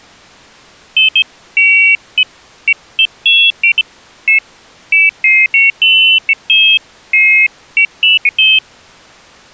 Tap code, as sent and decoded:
none

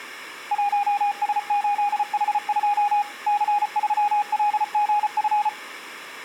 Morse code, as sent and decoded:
.---- ... ---.. .... ..--- / -.-. ...-- .-.. --. ..-.
1S8H2 C3LGF

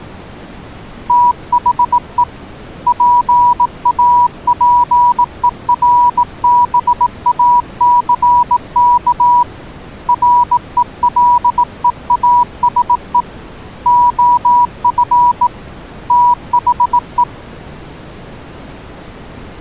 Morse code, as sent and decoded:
- .... . / .--. .- .--. . .-. -... .- -.-. -.- / .-. . .-.. . .- ... . / --- ..-. / - .... .
THE PAPERBACK RELEASE OF THE

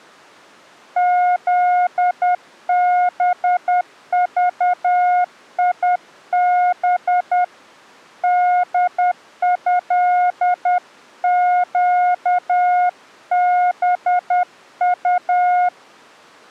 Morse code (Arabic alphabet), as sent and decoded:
--.. -... ...- .. -... / -.. ..-.. --.- -... ..-
ذبضيب دهقبط

